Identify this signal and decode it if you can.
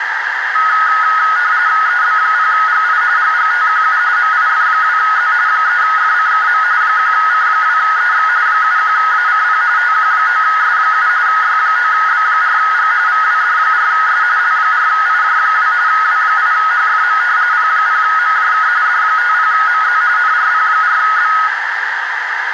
RTTY (45.45 baud, 170 Hz shift), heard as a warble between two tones, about 1360 Hz centre, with radio static and a narrow filter. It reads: EB0GI GGTQU MIF2Z 3FCKM 1C2EX 71ACP TQ9S7 Y9B4G VWD4S L4IJ2 W8HFM P0MJK D50MZ NRP4B